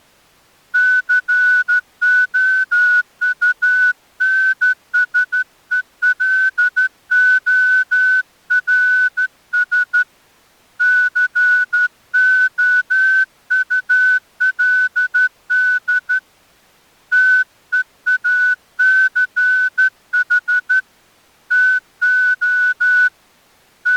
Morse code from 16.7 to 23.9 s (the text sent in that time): TEACH TO …